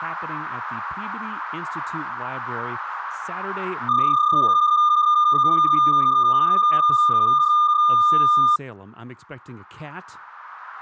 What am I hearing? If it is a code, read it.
PSK31 (31.25 baud), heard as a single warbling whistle, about 1210 Hz, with speech in English.